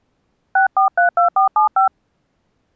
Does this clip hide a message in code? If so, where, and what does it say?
Yes: DTMF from 0.6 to 1.9 s, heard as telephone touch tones, dialled by hand, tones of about 120 ms. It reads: 6432475